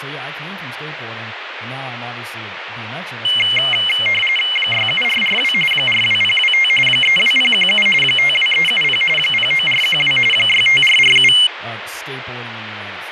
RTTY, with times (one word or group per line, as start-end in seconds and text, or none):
4.6-5.5 67442
5.7-6.7 42025
6.9-7.9 32017
8.0-9.0 52370
9.2-10.2 09412
10.3-11.3 65447